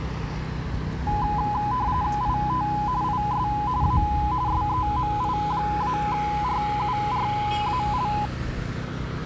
RTTY (45.45 baud, 170 Hz shift), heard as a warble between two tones, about 920 Hz centre, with the noise of a residential street. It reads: IT IS A SEMI-RURAL